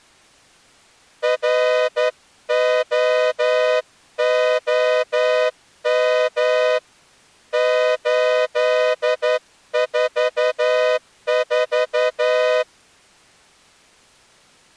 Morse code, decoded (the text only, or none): ROOM 844